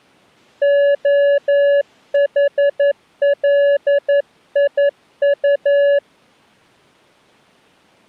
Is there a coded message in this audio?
Yes: Morse code (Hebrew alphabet) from 0.6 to 6.0 s, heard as a keyed tone, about 11 wpm, 570 Hz. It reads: החליט